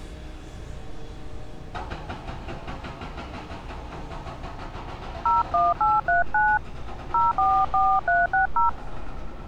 DTMF, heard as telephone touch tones, dialled by hand, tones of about 200 ms, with street noise. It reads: 01839 044360